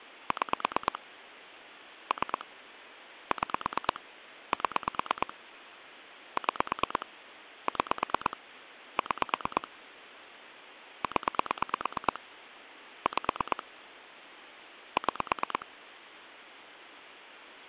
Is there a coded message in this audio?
Yes: pulse dialling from 0.3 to 15.6 s, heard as clicks on a phone line, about 9 pulses a second. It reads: 6 3 6 7 6 6 6 0 5 6